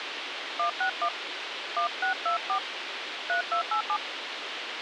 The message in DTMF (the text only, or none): 161 1624 3287